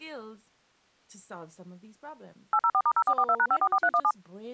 DTMF, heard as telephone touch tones, dialled by machine, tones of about 60 ms, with speech in English. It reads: 804*0442#544317